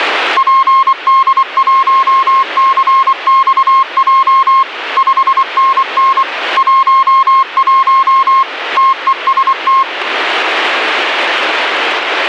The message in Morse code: PD1CXJ 5NN 11 TEST

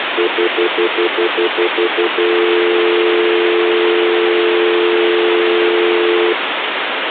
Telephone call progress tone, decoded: stutter dial tone

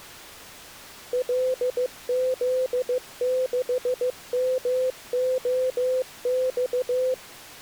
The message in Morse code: LZ6MOX

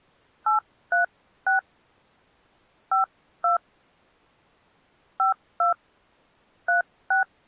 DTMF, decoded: 836 52 52 36

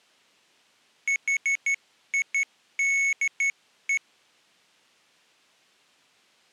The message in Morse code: HIDE

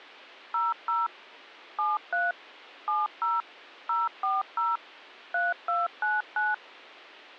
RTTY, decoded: none

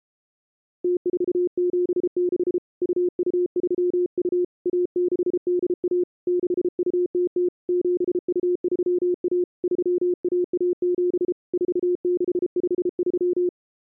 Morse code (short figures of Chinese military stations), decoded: 0476 2232 1681 6200 7231 3117 4653

